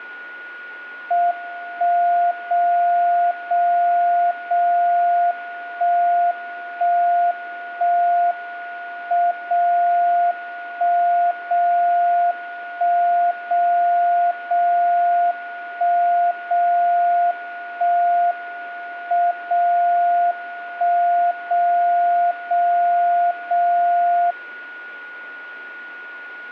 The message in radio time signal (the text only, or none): 1 0 0 0 1 1 1 M 0 1 0 1 0 0 1 0 1 M 0 1 0 0 0